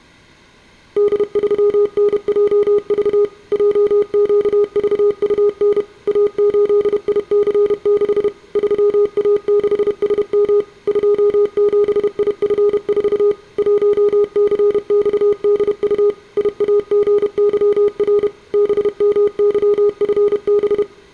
Morse code, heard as a keyed tone, machine-sent, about 31 wpm, 410 Hz, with room echo. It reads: D3NJV JQVUN A8IC6 3A6SM 27IF4 1CXDU IAGYR BMYFB